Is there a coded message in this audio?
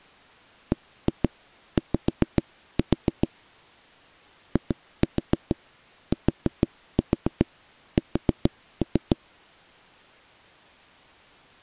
Yes: tap code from 0.7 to 9.2 s, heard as knocks on wood, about 6 knocks a second. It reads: BY ITS